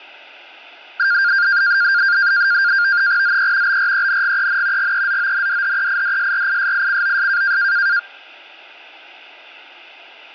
NAVTEX (SITOR-B), 100 baud, 170 Hz shift, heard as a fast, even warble, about 1500 Hz centre. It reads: ZE BRENGEN GEZONDHEIDSRISICOS